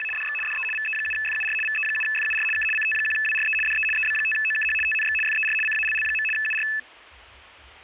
RTTY (75 baud, 850 Hz shift), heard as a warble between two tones, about 2150 Hz centre, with radio static and the noise of a park. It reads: … DX DE VE7FUR VE7FUR K CT1WRE DE EB5OKH TNX FER CALL. UR